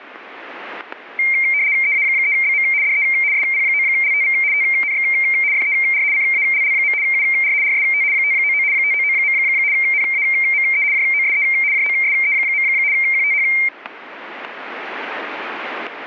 RTTY (75 baud, 170 Hz shift), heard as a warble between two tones, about 2200 Hz centre, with static crashes. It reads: EA3BM DE SP9LTV TNX FER CALL. UR RST 599 599. NAME JOSE JOSE. QTH